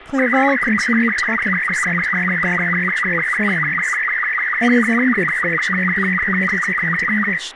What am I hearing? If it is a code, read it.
SSTV (slow-scan television), Robot 36, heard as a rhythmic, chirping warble, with radio static, room echo and speech in English.